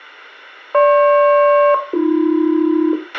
Aircraft SELCAL, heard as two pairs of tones, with a squelch burst at the end and room echo. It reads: GP-AB